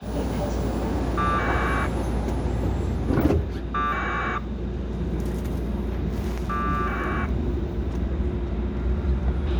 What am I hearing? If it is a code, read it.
Packet radio (AX.25, as in APRS), 1200 baud, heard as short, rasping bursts, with a squelch burst at the end and the noise inside a subway train.